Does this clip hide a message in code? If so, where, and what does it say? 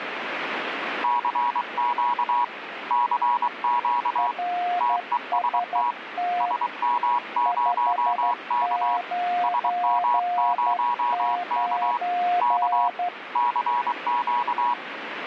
Yes: Morse code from 1.0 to 14.8 s, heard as two keyed tones, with radio static. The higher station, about 23 wpm, 970 Hz: CQ CQ TEST SM0K SM0K K CQ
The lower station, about 12 wpm, 710 Hz: RST 599